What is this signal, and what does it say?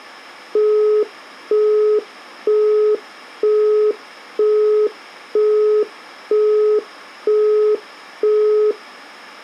Telephone call progress tone (single-tone plan, as in Europe, Japan and elsewhere), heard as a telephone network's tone, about 420 Hz, 0.48 s on and 0.48 s off. Busy tone.